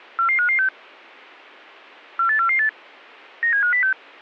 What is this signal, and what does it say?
Five-tone selective call (CCIR), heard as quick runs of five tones, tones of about 100 ms. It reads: 44556 48448 97506